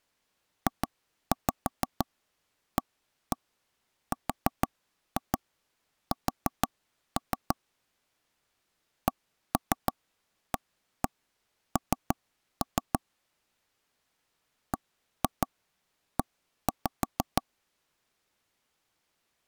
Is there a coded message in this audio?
Yes: tap code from 0.7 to 17.4 s, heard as taps on a table, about 6 knocks a second. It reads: JARS CAN BE